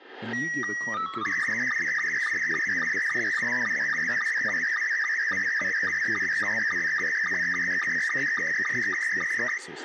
SSTV (slow-scan television), Scottie S2, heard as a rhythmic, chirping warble, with room echo and speech in English.